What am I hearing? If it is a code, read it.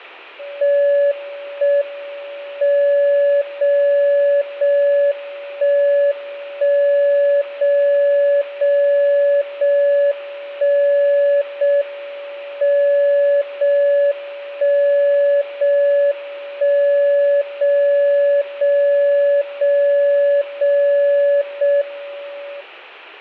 Radio time signal (JJY), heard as a tone whose level steps once a second, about 570 Hz, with room echo. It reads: 1 M 0 0 1 1 0 0 0 1 0 M 0 1 0 1 0 0 0 0 0 M